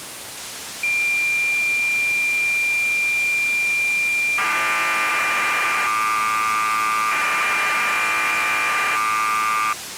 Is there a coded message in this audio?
Yes: cassette data (Kansas City type), 1200 baud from 0.8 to 9.7 s, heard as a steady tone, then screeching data, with tape hiss.